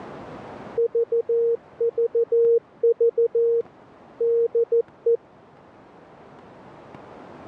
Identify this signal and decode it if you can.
Morse code, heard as a keyed tone, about 14 wpm, 460 Hz. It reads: VVV DE